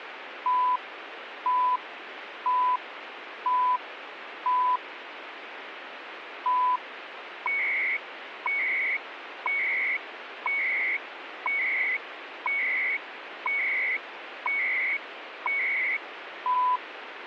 Radio time signal (CHU, Canada), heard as beeps and data bursts, one a second, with radio static.